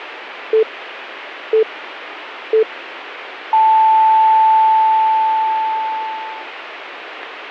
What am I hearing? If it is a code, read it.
Radio time signal (three low pips and a long one an octave up, as on NHK), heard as pips.